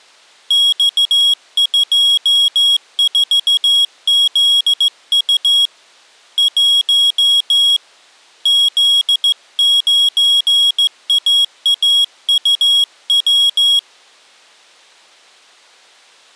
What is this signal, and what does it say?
Morse code, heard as a high beeper, hand-sent with a straight key, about 15 wpm, 3300 Hz. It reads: X24ZU 1 Z9AAUW